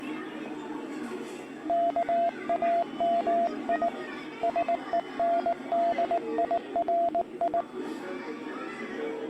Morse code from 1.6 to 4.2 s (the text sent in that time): KAMI